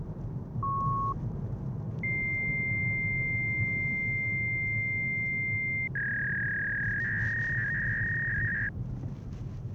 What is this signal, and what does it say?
Fax machine handshake, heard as a beep, a long tone and a warble, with the noise inside a car.